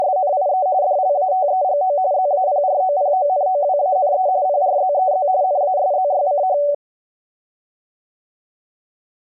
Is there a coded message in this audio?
Yes: RTTY (45.45 baud, 170 Hz shift) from 0.0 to 6.7 s, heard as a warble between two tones, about 660 Hz centre. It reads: … DLATEGO ZAPROPONOWANE PRZEZ NASZYCH